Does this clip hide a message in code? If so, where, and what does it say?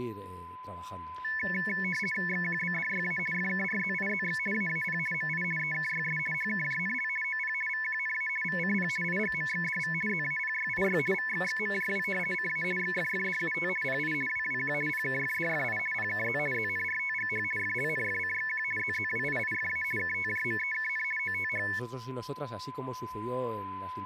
Yes: RTTY (50 baud, 450 Hz shift) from 1.2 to 21.8 s, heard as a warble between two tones, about 2000 Hz centre, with a steady whistle near 1010 Hz and speech in Spanish. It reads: XQBDYA FKRZIZX AAP MI EKYS HKJNL OP VQNA VCP IGMXDV ZAPYIY VXXMJW CA XFFDUT PI WWQ PKFDFI PKZ ZNRTGH FLNFCXQ ZZWIIFA KTJMEKN OTH